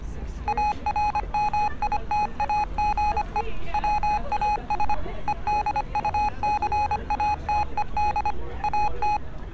Morse code, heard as electronic beeps, machine-sent, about 25 wpm, 840 Hz, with street noise. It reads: ARMITAGE WAS EDUCATED AT